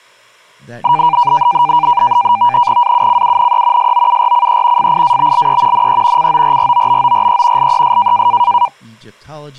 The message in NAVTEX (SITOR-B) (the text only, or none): AUCUNE SOURCE FIABLE NE CORROBORE LES